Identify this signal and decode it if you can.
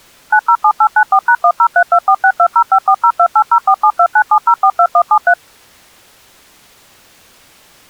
DTMF, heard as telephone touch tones, dialled by machine, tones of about 70 ms. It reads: 907894#1032462054028047297042173